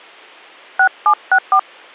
DTMF, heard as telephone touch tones, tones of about 80 ms. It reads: 6764